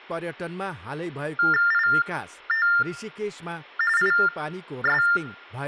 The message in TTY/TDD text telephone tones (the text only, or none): IT IS